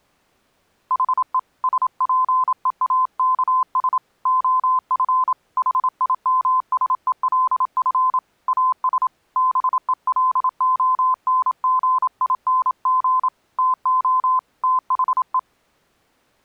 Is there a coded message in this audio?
Yes: Morse code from 0.8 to 15.5 s, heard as a keyed tone, hand-sent with a paddle, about 27 wpm, 1030 Hz. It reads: HE SPEAKS OF HIMSELF AS BELONGING TO THE